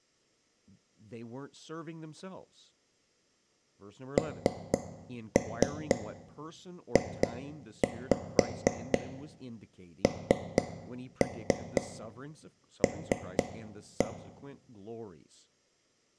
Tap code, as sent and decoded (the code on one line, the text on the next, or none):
3-3 2-5 3-3 3-1
NJNL